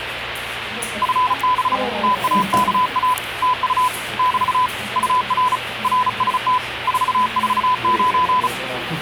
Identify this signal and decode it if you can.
Morse code, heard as a keyed tone, hand-sent with a paddle, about 35 wpm, 1000 Hz, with radio static and the noise of a crowd indoors. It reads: FB TAKA TU <BT> UR RST 449